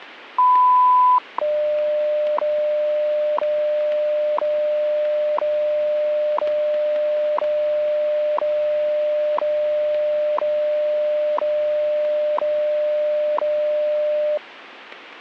Radio time signal (WWV, Colorado), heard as ticks, one a second, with radio static.